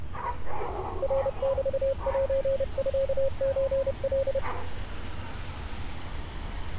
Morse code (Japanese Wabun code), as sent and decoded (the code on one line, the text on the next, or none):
.-. -...- .---. ..-.- ---. .-..
ナメセミソカ